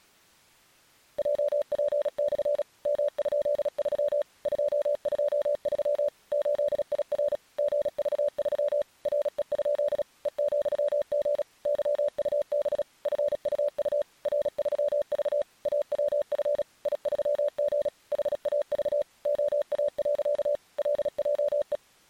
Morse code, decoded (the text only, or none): JP/ M?3 223 8IR GV3 RE? E,G YUB FUU R3V AWF I3G HAV OA. LJE